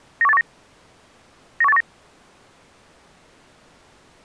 Five-tone selective call (EEA), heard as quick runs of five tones, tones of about 40 ms. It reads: 91819 91819